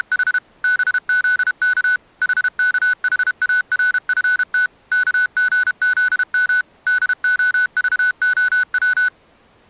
Morse code, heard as electronic beeps, machine-sent, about 32 wpm, 1490 Hz. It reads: … BZK HKHARFT KGZM DOVOW